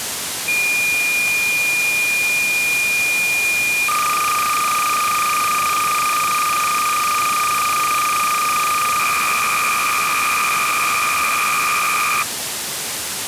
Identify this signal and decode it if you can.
Cassette data (Kansas City type), 300 baud, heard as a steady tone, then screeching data, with tape hiss.